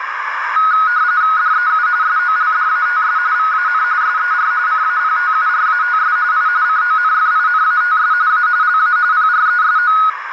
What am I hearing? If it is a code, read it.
RTTY (45.45 baud, 170 Hz shift), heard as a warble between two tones, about 1360 Hz centre, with radio static and a narrow filter. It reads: DEU SOLDATS VAN SER CAPTURATS I CONFINATS A LA PRESO